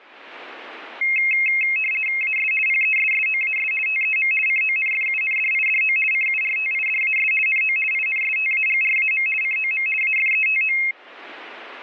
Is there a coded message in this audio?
Yes: RTTY (50 baud, 450 Hz shift) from 1.0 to 10.9 s, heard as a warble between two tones, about 2350 Hz centre. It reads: AS PESSOAS TEM CONFUNDIDO CURTIDAS NO INSTAGRAM COM AFETO